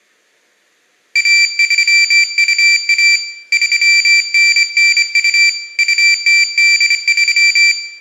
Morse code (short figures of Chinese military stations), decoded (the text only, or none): 1321 3992 2083